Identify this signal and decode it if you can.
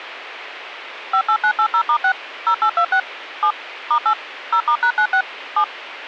DTMF, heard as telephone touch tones, dialled by machine, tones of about 80 ms. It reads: 58980*6 0826 7 *8 0*#96 7